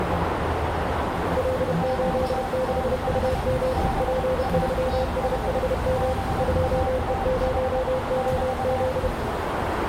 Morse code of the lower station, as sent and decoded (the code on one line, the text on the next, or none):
.-.. ---.. -.... ..- -- / .--. ...-- ... .... -- / ..--- . ----- --- --..
L86UM P3SHM 2E0OZ